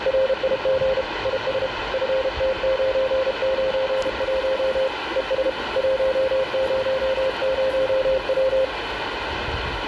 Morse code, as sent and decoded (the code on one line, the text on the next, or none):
.-. .. --. / .. ... / ..-. - ----. ----. .---- / . ... / .---- ----- ----- .--
RIG IS FT991 ES 100W